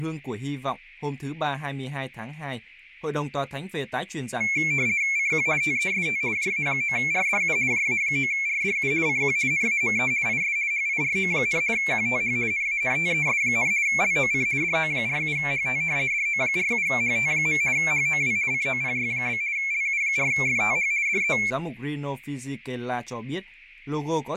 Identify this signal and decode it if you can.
RTTY (50 baud, 170 Hz shift), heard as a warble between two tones, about 2250 Hz centre, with radio static and speech in Vietnamese. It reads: CQ TEST JA9RDU JA9RDU CQ NAME IS HIRO, QTH NANTES, LOC DO47HT DO47HT. HOW COPY? LU4FTH DE